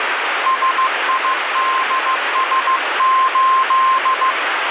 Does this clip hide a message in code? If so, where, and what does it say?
Yes: Morse code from 0.4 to 4.4 s, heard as a keyed tone, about 15 wpm, 1050 Hz, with heavy radio static. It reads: SIDS8